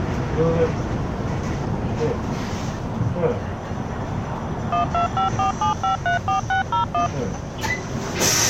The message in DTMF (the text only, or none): 12547534601